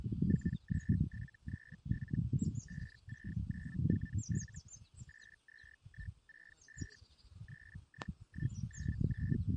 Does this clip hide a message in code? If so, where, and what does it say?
Yes: Hellschreiber (Feld-Hell, 122.5 baud) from 0.3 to 9.4 s, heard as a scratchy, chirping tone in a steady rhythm, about 1800 Hz, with the noise of a park. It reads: 43737 56947 82165 31199